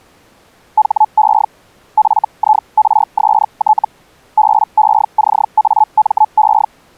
Hellschreiber (Feld-Hell, 122.5 baud), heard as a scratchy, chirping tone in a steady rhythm, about 860 Hz. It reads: HE FIRST BECAME